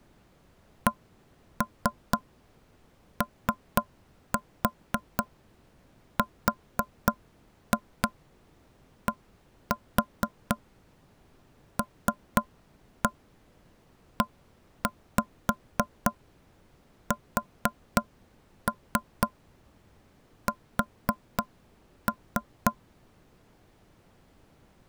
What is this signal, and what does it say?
Tap code, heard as knocks on wood, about 3 knocks a second. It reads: CORDLESS